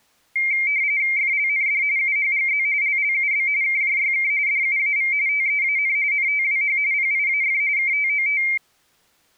RTTY (45.45 baud, 170 Hz shift), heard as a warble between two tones, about 2200 Hz centre. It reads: FLND UHGZ LLUB KJYK DUAV TEAN NTWH PIAF KTOT